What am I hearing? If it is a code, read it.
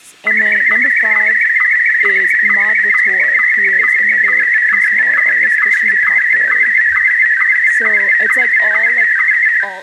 SSTV (slow-scan television), Martin M1, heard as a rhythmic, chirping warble, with room echo and speech in English.